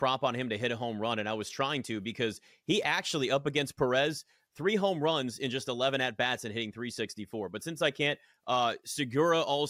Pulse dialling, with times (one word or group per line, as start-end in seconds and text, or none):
none